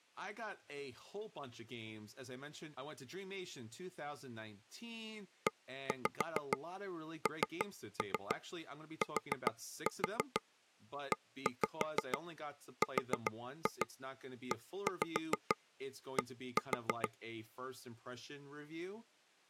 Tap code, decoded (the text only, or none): ENTERED